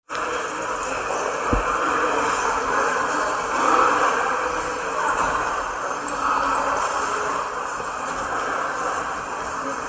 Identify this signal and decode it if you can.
The noise of a subway station. There is no code.